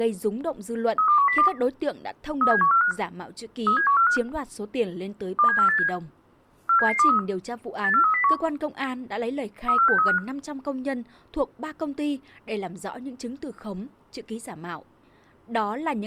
Five-tone selective call (CCIR), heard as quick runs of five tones, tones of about 100 ms, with speech in Vietnamese. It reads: 32102 37145 37145 27487 47723 84301 34635